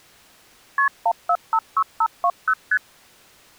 Multi-frequency trunk signalling (R1, as on North American trunks), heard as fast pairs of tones, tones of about 60 ms. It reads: KP 1456520 ST